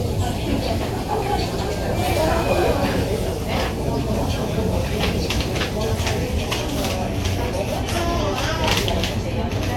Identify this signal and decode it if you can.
The noise of a crowd indoors. There is no code.